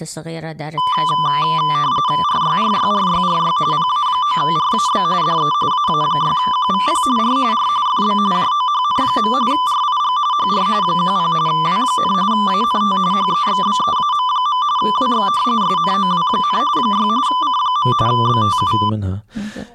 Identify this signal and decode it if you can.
RTTY (45.45 baud, 170 Hz shift), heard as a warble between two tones, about 1090 Hz centre, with speech in Arabic. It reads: RYRYRYRY PA9RAB DE AA6QVP R R FB JOHN. RIG HR 10 W, ANT HEXBEAM. WX SNOW, 6 C. BTU